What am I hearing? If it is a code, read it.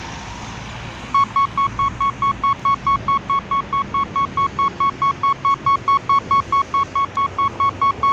Evenly repeated beeps, with street noise. There is no code.